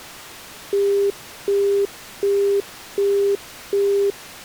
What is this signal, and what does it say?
Telephone call progress tone (as in the UK, Australia and similar networks), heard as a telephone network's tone, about 400 Hz, 0.375 s on and 0.375 s off. Busy tone.